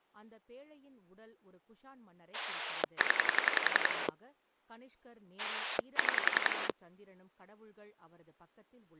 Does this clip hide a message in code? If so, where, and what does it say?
Yes: pulse dialling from 2.3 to 6.7 s, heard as a rotary dial, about 11 pulses a second, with speech in Tamil. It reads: 0 6